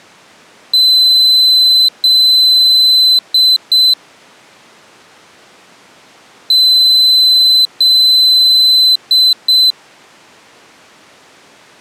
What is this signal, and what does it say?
Beep code, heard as a piezo beeper, played twice, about 4050 Hz. 2 long, 2 short.